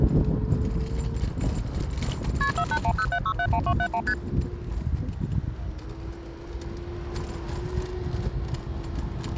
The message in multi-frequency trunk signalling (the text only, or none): KP 48107671271 ST